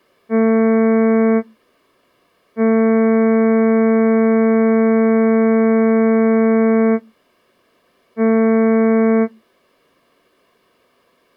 Ship horn signal, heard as a ship's horn, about 220 Hz. 1 short, 1 long, 1 short. At sea: a vessel at anchor warns of its position.